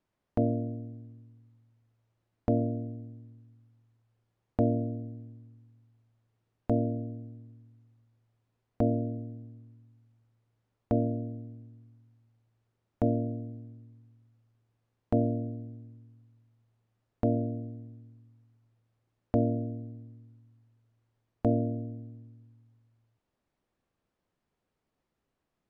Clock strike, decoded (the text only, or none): 11